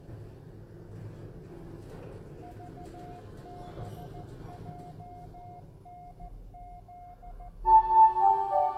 Morse code, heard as a keyed tone, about 14 wpm, 710 Hz, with the noise inside a lift. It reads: VBJNZ